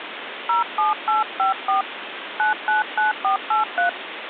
DTMF, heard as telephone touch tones, dialled by hand, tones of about 130 ms, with phone line noise. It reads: 07854 999483